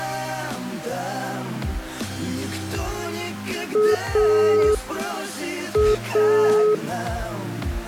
Telephone call progress tone (pulsed, as in Italy), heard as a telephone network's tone, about 420 Hz. Dial tone.